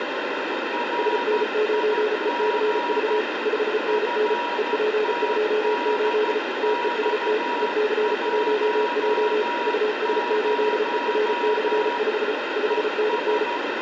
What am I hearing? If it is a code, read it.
Morse code, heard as two keyed tones, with heavy radio static. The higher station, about 13 wpm, 960 Hz: RIG FTDX10 ES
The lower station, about 34 wpm, 430 Hz: SN9ECV 5NN EP28 TEST EC1J US8ER/5 5NN